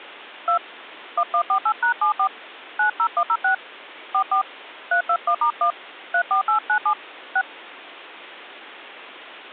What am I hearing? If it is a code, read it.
DTMF, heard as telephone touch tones, dialled by hand, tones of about 80 ms. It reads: 2 1148#74 90106 44 321*1 34897 6